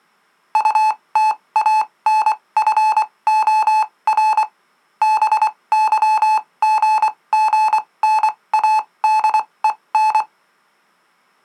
Morse code, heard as electronic beeps, machine-sent, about 24 wpm, spaced as for 19 wpm, 870 Hz. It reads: UTANFOR BYGGNADEN